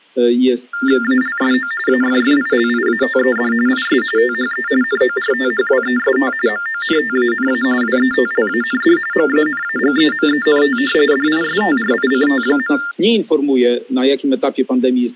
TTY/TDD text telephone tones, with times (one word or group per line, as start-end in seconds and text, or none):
1.0-1.7 ALSO
1.9-3.5 AFFILIATED
3.7-4.0 IS
4.2-4.7 THE
4.8-6.3 NORTHWEST
6.5-7.6 MONTANA
7.8-9.0 WETLAND
9.1-10.8 MANAGEMENT
11.1-12.8 DISTRICT.